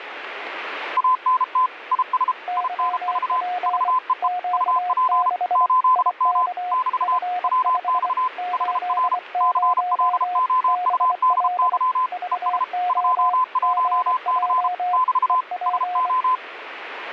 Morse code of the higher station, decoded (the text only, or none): ANT IS INV VEE UP 8M <BT> WX HR CLOUDY ES 21C <BT> SO